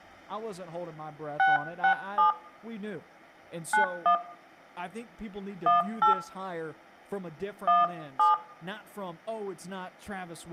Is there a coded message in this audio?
Yes: DTMF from 1.4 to 8.3 s, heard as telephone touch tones, dialled by hand, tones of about 140 ms, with room echo and speech in English. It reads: 667 91 18 17